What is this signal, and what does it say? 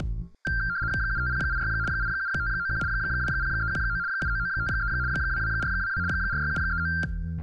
RTTY (75 baud, 170 Hz shift), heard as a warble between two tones, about 1480 Hz centre. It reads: 75086 87591 20319 79953 22422 46739